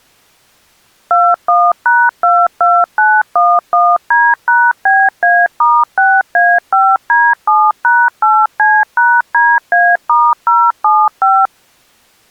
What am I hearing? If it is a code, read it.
DTMF, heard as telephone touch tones, dialled by machine, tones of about 240 ms. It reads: 21#22911D#BA*6A5D7#8C#DA*075